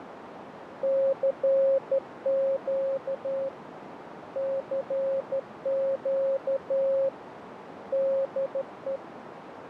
Morse code, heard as a keyed tone, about 13 wpm, 540 Hz, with radio static and a narrow filter. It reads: CQ CQ DE